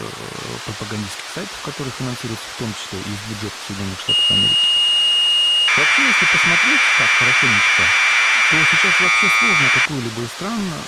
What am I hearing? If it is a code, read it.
Commodore tape loading (standard loader), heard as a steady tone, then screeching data, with tape hiss and speech in Russian.